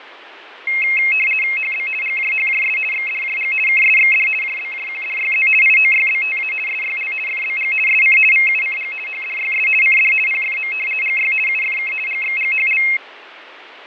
RTTY (50 baud, 450 Hz shift), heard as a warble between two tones, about 2350 Hz centre, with radio static and fading. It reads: HB GJHJS XDJG KSXD JBJQDYZ IOYBTA SYL FBG SC VUCG HDYS CD PFM GY UFK GXGHL